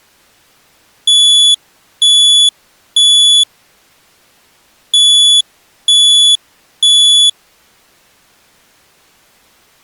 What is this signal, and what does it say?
Alarm pattern, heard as an alarm's beeps, played twice, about 3400 Hz. Temporal three. Smoke or fire, evacuate.